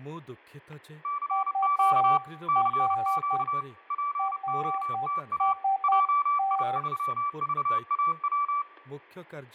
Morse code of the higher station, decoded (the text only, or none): CQ CQ POTA JI3VAW